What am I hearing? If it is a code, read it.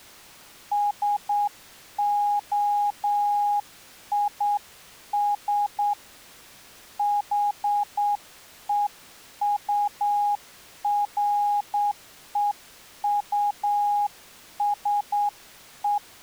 Morse code, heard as a keyed tone, hand-sent with a straight key, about 8 wpm, 820 Hz. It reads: SOIS HEUREUSE